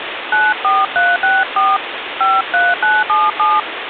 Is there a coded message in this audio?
Yes: DTMF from 0.3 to 3.6 s, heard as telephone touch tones, dialled by hand, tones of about 200 ms, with phone line noise. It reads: 94364 53977